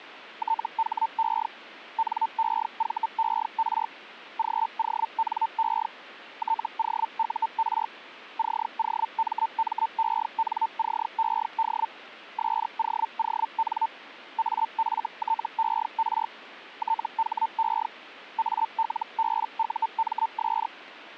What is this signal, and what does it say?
Hellschreiber (Feld-Hell, 122.5 baud), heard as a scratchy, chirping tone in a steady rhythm, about 900 Hz. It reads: THE NEVER GONE TOUR COMMENCED SOON AFTER THE ALBUMS